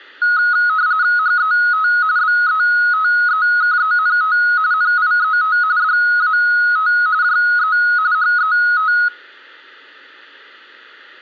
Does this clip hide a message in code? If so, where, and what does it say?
Yes: RTTY (45.45 baud, 170 Hz shift) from 0.2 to 9.1 s, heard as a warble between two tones, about 1360 Hz centre. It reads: HET BETEKENT NIET DAT JE HET